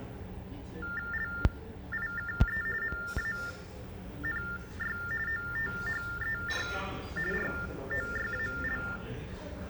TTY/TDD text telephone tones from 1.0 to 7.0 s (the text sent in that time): LIKE MANY OTHER